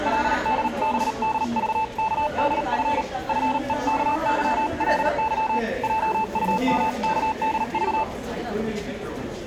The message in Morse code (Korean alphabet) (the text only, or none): 그들은 나에게 힘을